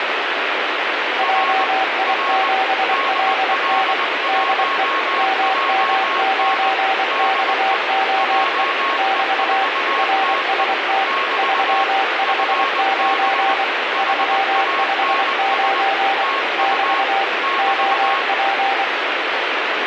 Morse code, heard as two keyed tones, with heavy radio static. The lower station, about 24 wpm, 780 Hz: JI7LN DE MM9XOE <BT> RST 359 359 <BT> OP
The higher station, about 20 wpm, 1090 Hz: R R DL1JN DE JE4TE <BT> FB HANS TU <BT>